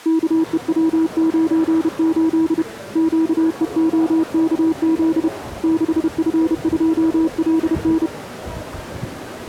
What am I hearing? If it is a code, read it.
Morse code, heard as a keyed tone, hand-sent with a paddle, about 31 wpm, 320 Hz, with the noise of a crowd indoors. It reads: KEW98 QEOKZ 6F2LN